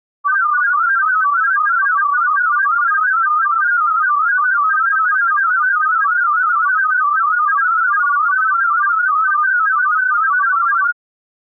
Multi-tone FSK (Olivia or MFSK type), about 500 Hz wide, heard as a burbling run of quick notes, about 31.25 baud.